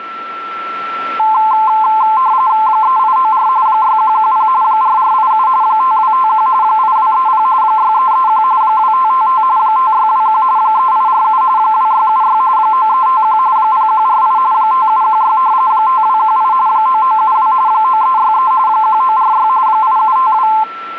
RTTY (45.45 baud, 170 Hz shift), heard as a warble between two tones, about 960 Hz centre, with a steady whistle near 1340 Hz. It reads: 3894 6110 4487 5251 8230 6331 2555 5621 3847 2676 9351 0148 5716 5218 9972 9363 1946 8752